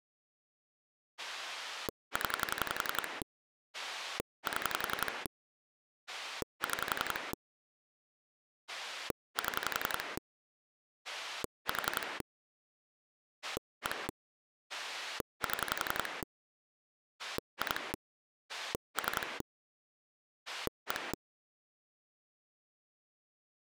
Pulse dialling, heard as a rotary dial, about 11 pulses a second. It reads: 0 7 6 7 4 1 7 2 3 1